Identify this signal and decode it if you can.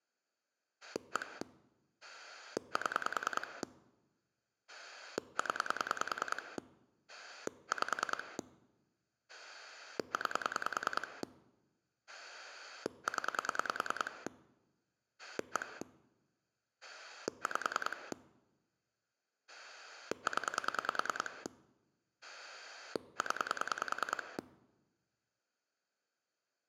Pulse dialling, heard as a rotary dial, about 10 pulses a second. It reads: 1 7 0 5 9 0 1 5 0 0